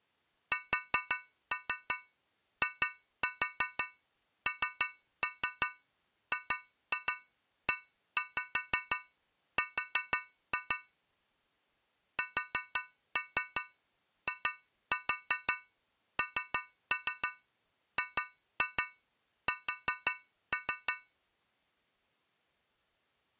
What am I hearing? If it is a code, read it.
Tap code, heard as taps on a metal pipe, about 5 knocks a second. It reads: SINGER SINGS